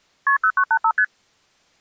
Multi-frequency trunk signalling (R1, as on North American trunks), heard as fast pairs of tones, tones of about 70 ms. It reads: KP 0985 ST